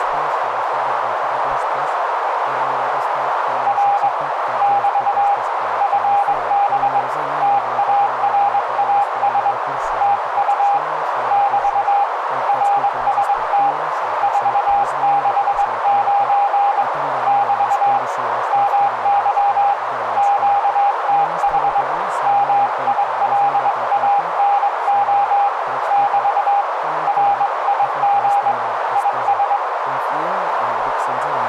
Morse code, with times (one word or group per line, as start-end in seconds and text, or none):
3.7-4.1 R
4.6-5.3 <BT>
5.8-7.0 FB
7.4-9.5 TARAS
10.0-10.8 TU
11.3-12.0 <BT>
12.5-13.7 RST
14.2-16.8 469
17.3-18.0 <BT>
18.5-19.7 MY
20.2-21.8 QTH
22.3-25.5 MILANO
25.9-26.6 <BT>
27.1-28.5 RIG
29.0-29.6 IS